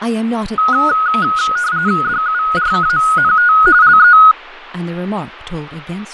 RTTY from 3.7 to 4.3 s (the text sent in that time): LE